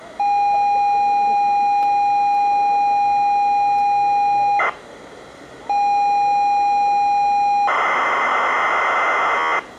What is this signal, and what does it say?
ZX Spectrum tape loading, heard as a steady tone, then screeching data, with the noise of a crowd indoors.